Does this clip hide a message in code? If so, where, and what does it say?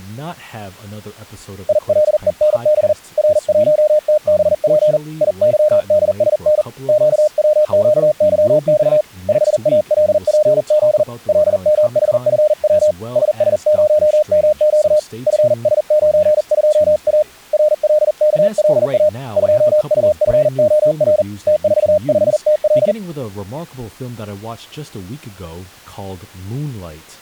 Yes: Morse code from 1.6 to 23.0 s, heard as a keyed tone, hand-sent with a paddle, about 40 wpm, 610 Hz, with speech in English. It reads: ILENB R1TBP IYDSN QWQYX 5ALPZ LMHFW SS0MQ FS92A RLKLA 2UFOR T45TL